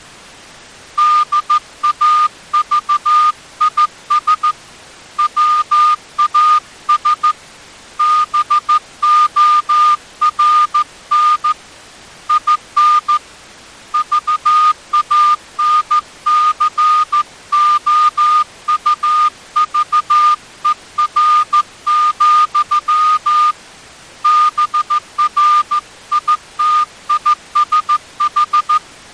Morse code, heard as a whistle, hand-sent with a straight key, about 14 wpm. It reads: DAVIS WAS BORN IN VANCOUVER, BRITISH